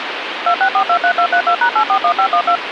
DTMF, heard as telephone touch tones, dialled by machine, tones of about 80 ms, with phone line noise. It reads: 26423232#841512